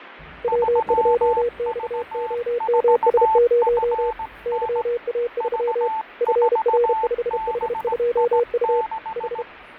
Morse code, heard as two keyed tones, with radio static, fading and the noise inside a lift. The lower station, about 32 wpm, 480 Hz: W2XOMS0 YA3 FR5H2U H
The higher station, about 17 wpm, 880 Hz: 3V4FN V4BI6